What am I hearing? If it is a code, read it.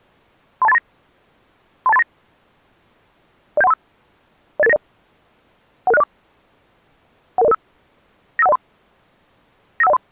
Five-tone selective call (EIA), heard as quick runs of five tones, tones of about 30 ms. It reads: 32839 32839 07135 08890 11604 11005 95103 95103